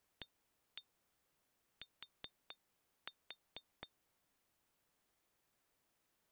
Tap code, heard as taps on glass, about 4 knocks a second. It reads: AT